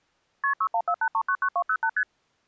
Multi-frequency trunk signalling (R1, as on North American trunks), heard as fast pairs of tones, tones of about 70 ms. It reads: KP 6148399208 ST